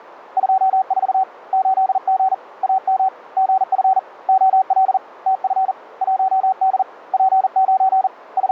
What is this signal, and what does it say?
Morse code, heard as a keyed tone, hand-sent with a paddle, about 40 wpm, 760 Hz. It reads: 24 8G AM GF OL TF 1D P9 …